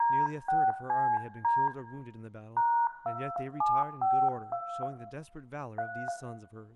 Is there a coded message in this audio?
Yes: DTMF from 0.0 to 6.1 s, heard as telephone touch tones, dialled by hand, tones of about 260 ms, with room echo and speech in English. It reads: D6CD #2752 3